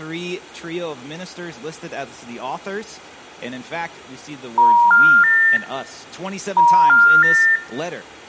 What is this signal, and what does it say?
Telephone call progress tone (ITU plan), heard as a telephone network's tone, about 950, 1400, 1800 Hz, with room echo. Special information tone.